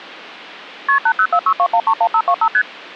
Multi-frequency trunk signalling (R1, as on North American trunks), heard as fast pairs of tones, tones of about 70 ms. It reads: KP 80462131525 ST